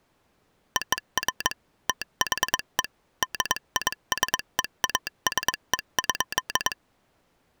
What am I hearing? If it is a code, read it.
Morse code (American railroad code), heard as a telegraph sounder, machine-sent. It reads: OF THE DISEASE.